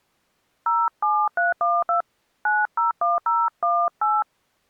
DTMF, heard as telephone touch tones, dialled by hand, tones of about 180 ms. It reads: 07312 901018